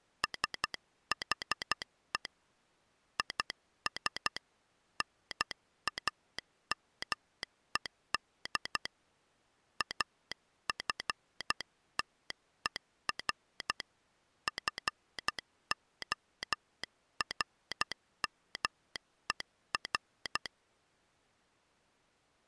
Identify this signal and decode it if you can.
Morse code, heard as a telegraph sounder, hand-sent with a paddle, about 12 wpm. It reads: SHE IS NAMED AFTER FORMER